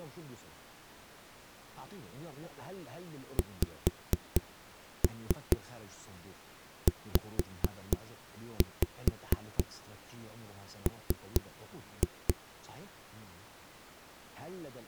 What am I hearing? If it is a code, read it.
Tap code, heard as knocks on a wall, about 4 knocks a second, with speech in Arabic. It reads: XZM